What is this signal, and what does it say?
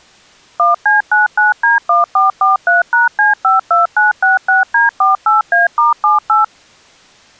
DTMF, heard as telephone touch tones, dialled by machine, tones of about 150 ms. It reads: 1C99D1443#C52966D48A*78